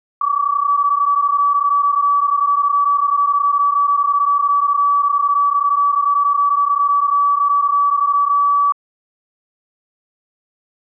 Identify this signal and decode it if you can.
PSK31 (31.25 baud), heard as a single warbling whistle, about 1150 Hz.